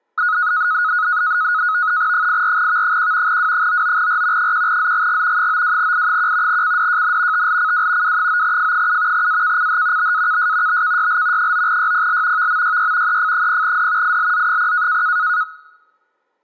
NAVTEX (SITOR-B), 100 baud, 170 Hz shift, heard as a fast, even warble, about 1360 Hz centre. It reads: 84V1 W99R 1ZGG 92I1 CDJN TLCW W9F7 AKCH BAKS BKYL 9YPL VMYY EF0D ILZ0